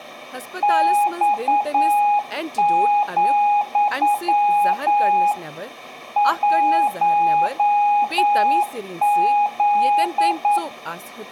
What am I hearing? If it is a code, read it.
Morse code, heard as a keyed tone, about 9 wpm, 820 Hz, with speech in Kashmiri. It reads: X, 1Z